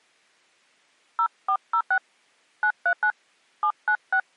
DTMF, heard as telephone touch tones, dialled by hand, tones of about 80 ms. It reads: 0406 939 796